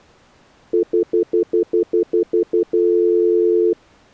Telephone call progress tone (North American plan), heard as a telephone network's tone, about 350, 440 Hz, 0.1 s on and 0.1 s off. Stutter dial tone.